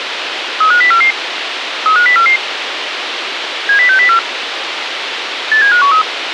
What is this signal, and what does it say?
Five-tone selective call (CCIR), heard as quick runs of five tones, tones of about 100 ms, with radio hiss. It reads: 35044 35044 70604 87513